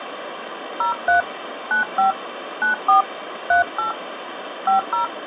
DTMF, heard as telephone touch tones, dialled by hand, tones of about 120 ms, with phone line noise. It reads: 03 95 94 38 50